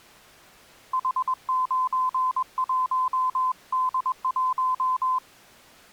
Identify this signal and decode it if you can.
Morse code, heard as a keyed tone, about 21 wpm, 1020 Hz. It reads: H91D1